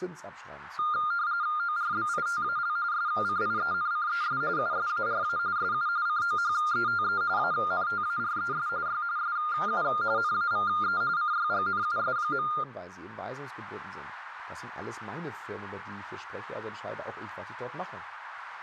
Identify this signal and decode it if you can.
RTTY (45.45 baud, 170 Hz shift), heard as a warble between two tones, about 1310 Hz centre, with radio static and speech in German. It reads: ORBITAL SCIENCES USARA SU COHETE ANTARES Y SU NAVE CYGNUS.